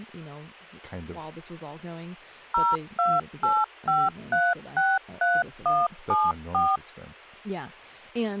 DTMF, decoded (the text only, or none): 0285363174